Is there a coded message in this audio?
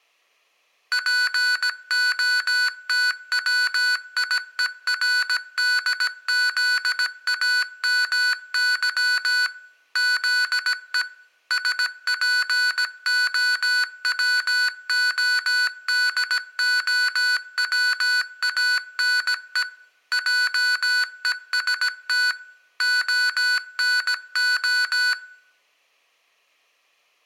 Yes: Morse code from 0.9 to 25.2 s, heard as electronic beeps, machine-sent, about 17 wpm, 1490 Hz, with room echo. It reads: POTWIERDZAMY ZE SPOWODOWANE JEST ONO